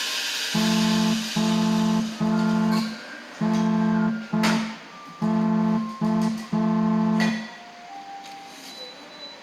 Morse code, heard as a horn, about 5 wpm, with room echo and the noise of a cafe. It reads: ONK